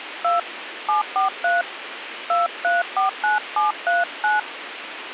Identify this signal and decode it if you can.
DTMF, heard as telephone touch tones, dialled by hand, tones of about 160 ms, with radio hiss. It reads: 2 743 2349739